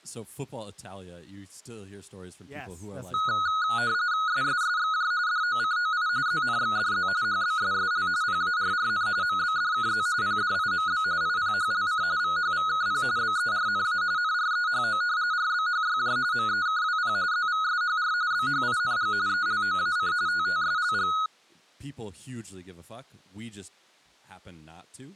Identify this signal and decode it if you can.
RTTY (45.45 baud, 170 Hz shift), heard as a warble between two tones, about 1360 Hz centre, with speech in English. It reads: SSSXJ DOCOI ZNXDZ HBSSL PARRN MBDKZ PDIMB IPHLC VHVKP BERNA NREHO RBHYJ MEKWP ZVSHR BHING ELOAC TTSLG